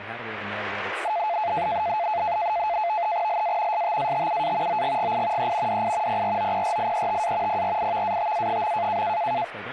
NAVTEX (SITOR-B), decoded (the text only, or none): LA STATUA OGGI E DI PROPRIETA PRIVATA.